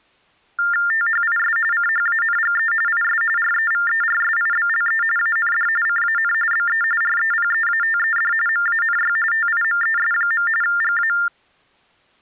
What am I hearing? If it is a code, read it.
TTY/TDD text telephone tones (45.45 baud Baudot), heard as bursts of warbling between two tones, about 400 Hz shift, 1600 Hz centre. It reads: THIS CHANGE IS REVERSIBLE AND CAN BE REPEATED MANY TIMES. GA